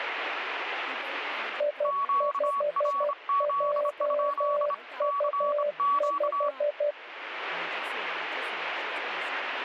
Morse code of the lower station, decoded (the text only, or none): I5JU5